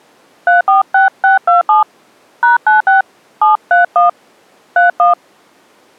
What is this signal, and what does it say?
DTMF, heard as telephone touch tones, dialled by hand, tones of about 140 ms. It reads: 346627 #96 731 31